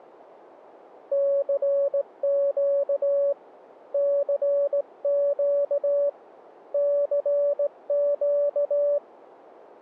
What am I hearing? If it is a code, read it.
Morse code, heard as a keyed tone, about 18 wpm, 570 Hz. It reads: CQ CQ CQ